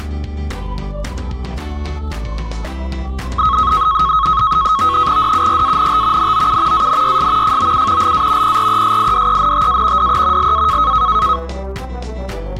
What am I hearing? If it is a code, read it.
NAVTEX (SITOR-B), 100 baud, 170 Hz shift, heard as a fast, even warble, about 1180 Hz centre. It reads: DURANT NOU ANYS FOU LA PRESIDENTA DE LA